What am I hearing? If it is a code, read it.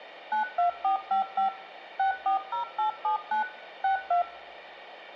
DTMF, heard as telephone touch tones, dialled by machine, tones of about 120 ms, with hum. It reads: 92455 640879 62